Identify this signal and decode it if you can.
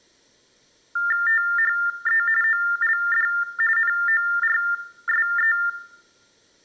TTY/TDD text telephone tones (45.45 baud Baudot), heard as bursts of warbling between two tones, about 400 Hz shift, 1600 Hz centre. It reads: THE OLD NORSE